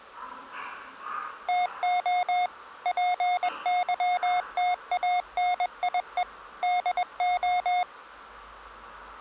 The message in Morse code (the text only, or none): TO PYTANIE DO